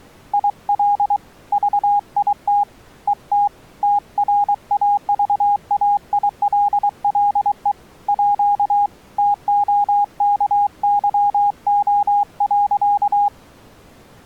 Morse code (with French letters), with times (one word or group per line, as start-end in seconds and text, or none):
0.3-1.2 IL
1.5-2.6 VIT
3.1-3.5 ET
3.8-7.7 TRAVAILLE
8.1-8.9 À
9.2-13.3 TOKYO.